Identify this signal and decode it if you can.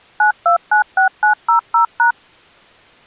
DTMF, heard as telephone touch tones, dialled by machine, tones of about 110 ms. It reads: 9296900#